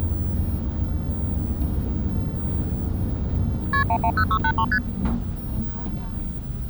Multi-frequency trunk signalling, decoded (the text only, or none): KP 110683 ST